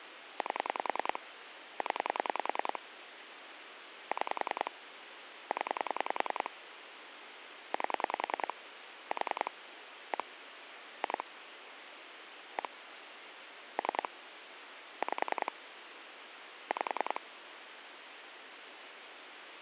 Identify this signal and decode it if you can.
Pulse dialling, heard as clicks on a phone line, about 10 pulses a second, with phone line noise. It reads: 8 0 6 0 8 4 1 2 1 3 5 5